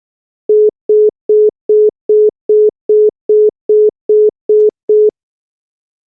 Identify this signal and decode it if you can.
Telephone call progress tone (single-tone plan, as in most of Europe), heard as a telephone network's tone, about 420 Hz, 0.2 s on and 0.2 s off. Congestion tone.